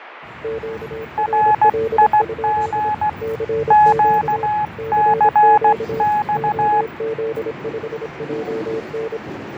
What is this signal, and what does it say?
Morse code, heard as two keyed tones, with radio static, fading and the noise inside a subway train. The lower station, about 26 wpm, 450 Hz: QRL? CQ CQ OZ5JN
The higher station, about 16 wpm, 840 Hz: RIG QCX